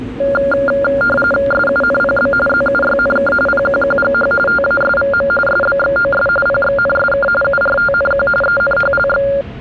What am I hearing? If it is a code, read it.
RTTY (45.45 baud, 850 Hz shift), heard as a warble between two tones, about 980 Hz centre, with static crashes and the noise inside a subway train. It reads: SUNPB ZUYNK PQQGH TASVM SBXOS PXNSK URTNQ ENHLX